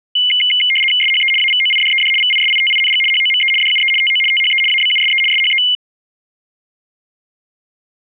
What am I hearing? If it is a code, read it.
RTTY (75 baud, 850 Hz shift), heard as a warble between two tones, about 2550 Hz centre. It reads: SHE AVOIDED VISITING HOME DUE TO THE ABUSE SHE